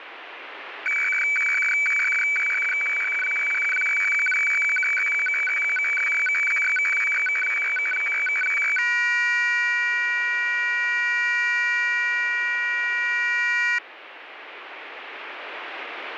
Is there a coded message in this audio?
Yes: weather fax (radiofax), 120 lines a minute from 0.9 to 13.8 s, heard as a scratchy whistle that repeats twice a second, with radio static.